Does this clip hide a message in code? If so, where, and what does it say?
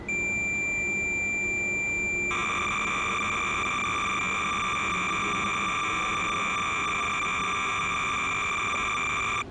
Yes: cassette data (Kansas City type), 300 baud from 0.1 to 9.4 s, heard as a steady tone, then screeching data, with the noise of a subway station.